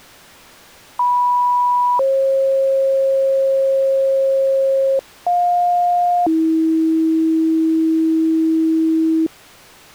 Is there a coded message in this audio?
Yes: two-tone page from 1.0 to 9.3 s, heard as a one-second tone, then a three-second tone, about 980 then 540 Hz, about 710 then 320 Hz.